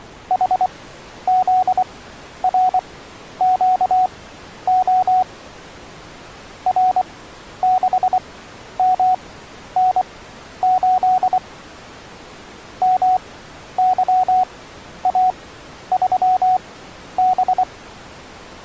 Morse code, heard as a keyed tone, machine-sent, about 24 wpm, spaced as for 11 wpm, 740 Hz. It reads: HZRQO R6MN8 MYA3B